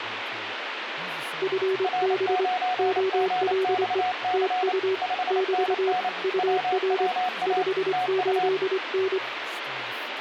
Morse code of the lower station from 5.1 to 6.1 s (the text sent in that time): <BT>